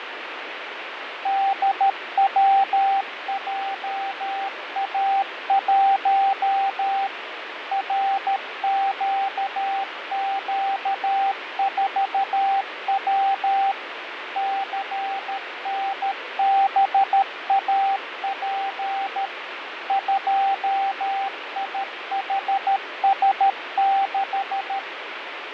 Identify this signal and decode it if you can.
Morse code, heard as a keyed tone, machine-sent, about 13 wpm, 780 Hz, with radio static and fading. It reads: DWJA1 RQQ4W CNBAP 2IHS6